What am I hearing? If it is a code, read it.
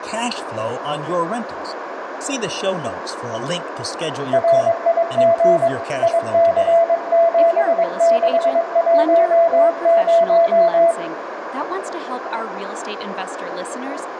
Morse code, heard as a keyed tone, hand-sent with a paddle, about 22 wpm, 670 Hz, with radio static, a narrow filter, room echo and speech in English. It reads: RIG IC7610